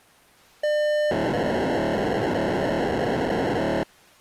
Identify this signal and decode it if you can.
POCSAG pager data (1200 baud), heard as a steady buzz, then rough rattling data.